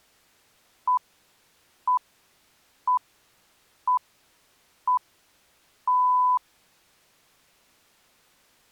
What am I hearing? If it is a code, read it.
Radio time signal (six pips, as the Greenwich Time Signal), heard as pips.